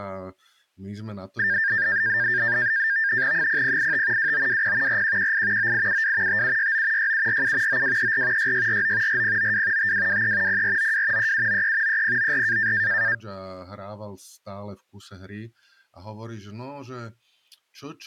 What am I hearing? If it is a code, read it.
NAVTEX (SITOR-B), 100 baud, 170 Hz shift, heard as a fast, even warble, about 1700 Hz centre, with speech in Slovak. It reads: 0085 2920 4118 9872 5769 6747 9234 6649 4092 5223 0492 3793 3094